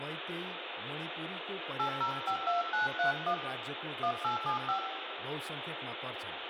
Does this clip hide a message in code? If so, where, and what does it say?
Yes: DTMF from 1.8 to 4.8 s, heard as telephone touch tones, dialled by hand, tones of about 120 ms, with phone line noise, room echo and speech in Nepali. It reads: 8052931 1875